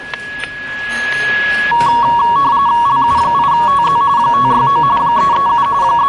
RTTY (45.45 baud, 170 Hz shift), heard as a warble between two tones, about 1030 Hz centre, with static crashes, a steady whistle near 1680 Hz and the noise of a restaurant. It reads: LU8TZ 569 337 …